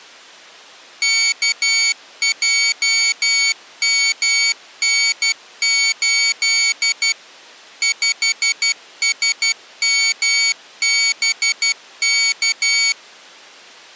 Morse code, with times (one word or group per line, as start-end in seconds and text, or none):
1.0-7.1 KJMN8
7.8-12.9 5SMBK